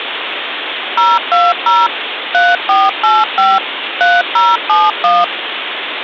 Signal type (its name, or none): DTMF